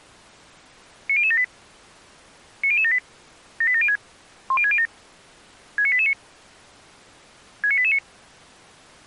Five-tone selective call (ZVEI), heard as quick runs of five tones, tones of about 70 ms. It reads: 90078 90078 78706 10607 69889 69889